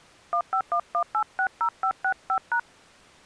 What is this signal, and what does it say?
DTMF, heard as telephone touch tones, dialled by hand, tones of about 80 ms. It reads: 1511860565#